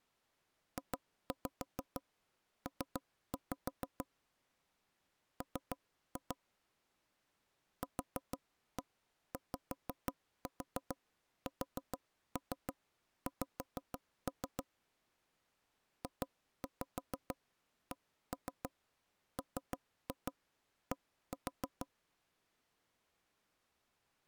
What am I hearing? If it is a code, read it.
Tap code, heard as taps on a table, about 6 knocks a second. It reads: JP M QYSX JCMD